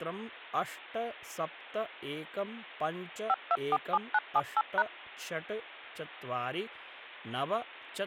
DTMF, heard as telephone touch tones, dialled by machine, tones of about 40 ms, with speech in Sanskrit. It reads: 5247978#